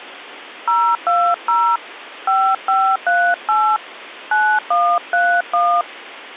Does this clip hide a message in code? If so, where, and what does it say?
Yes: DTMF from 0.7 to 5.8 s, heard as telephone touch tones, dialled by hand, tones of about 280 ms. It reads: 020 5538 9131